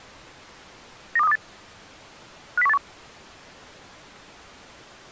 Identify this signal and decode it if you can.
Five-tone selective call (EEA), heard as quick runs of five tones, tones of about 40 ms. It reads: 92328 50181